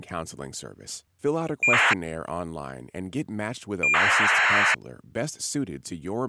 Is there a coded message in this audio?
Yes: ACARS aircraft data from 1.6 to 4.7 s, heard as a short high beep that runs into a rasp, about 2400 baud, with speech in English.